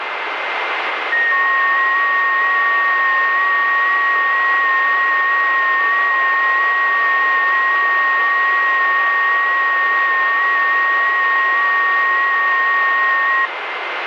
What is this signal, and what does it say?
FT8 (several signals at once), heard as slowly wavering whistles, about 6.25 baud, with radio static.